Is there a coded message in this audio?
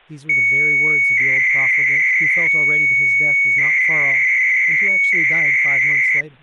Yes: 300-baud modem data (Bell 103 tones) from 0.3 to 6.2 s, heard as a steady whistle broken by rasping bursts, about 300 baud, 200 Hz shift, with speech in English.